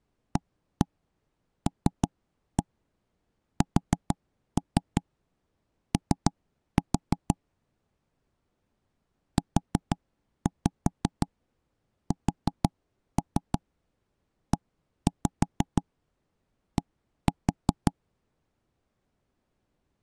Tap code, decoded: ALSO USED

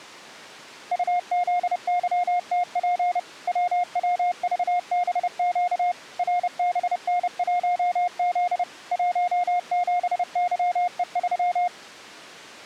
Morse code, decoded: UZYTP WWVBQ RBN1Z 17YE3

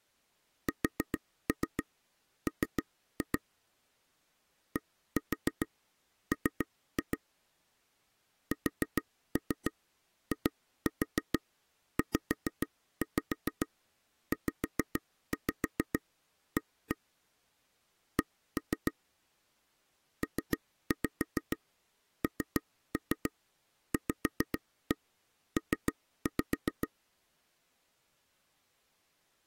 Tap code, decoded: SM DM SIZZA C PNVP

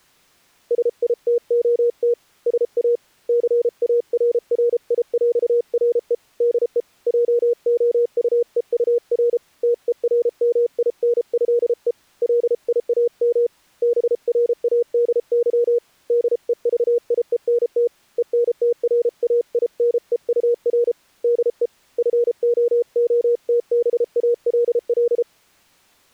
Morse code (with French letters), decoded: SITOT SA CARRIÈRE DE JOUEUR TERMINÉE LIAM BRADY DEVIENT ENTRAINEUR DE FOOTBALL

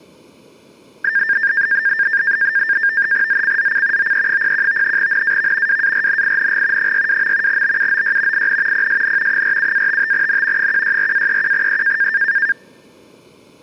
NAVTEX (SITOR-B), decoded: ZCZC OE01 NAV WARNING 62. BUOY IN PSN 47-55N 164-31E

